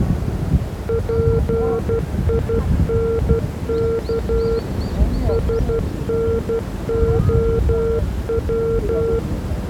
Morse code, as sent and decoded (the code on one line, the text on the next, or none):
.--. .. -. -.- / ... -. --- .--
PINK SNOW